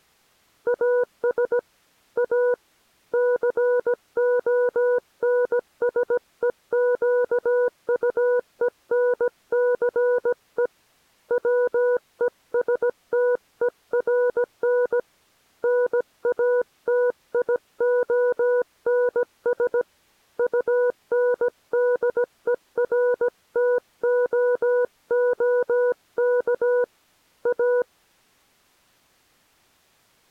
Morse code, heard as a keyed tone, hand-sent with a paddle, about 17 wpm, 490 Hz. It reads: AS A CONSEQUENCE WESTERN NATIONS UNDERTOOK A